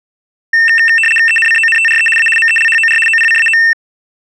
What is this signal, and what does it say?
RTTY (75 baud, 850 Hz shift), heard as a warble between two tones, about 2250 Hz centre. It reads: ENCONTRE A MELHOR OPCAO